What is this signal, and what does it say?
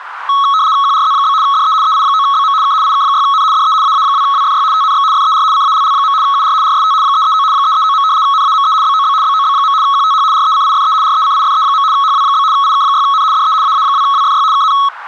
RTTY (75 baud, 170 Hz shift), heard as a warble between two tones, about 1200 Hz centre, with radio static and a narrow filter. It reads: QRZ? DE EI9BM K IK6N DE AA2WFY TNX FER CALL. UR RST 339 339. NAME BOB BOB. QTH RECIFE RECIFE. HW? IK6N DE AA2WFY KN